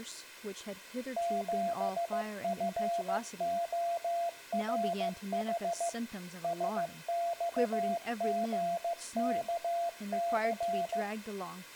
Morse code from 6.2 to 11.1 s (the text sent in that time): SXGKC